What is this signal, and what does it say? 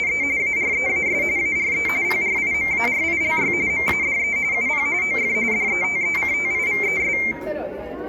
RTTY (45.45 baud, 170 Hz shift), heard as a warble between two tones, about 2200 Hz centre, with room echo and the noise of a crowd indoors. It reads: … AREAS ARE PRIMARILY MADE UP OF DETECTIVES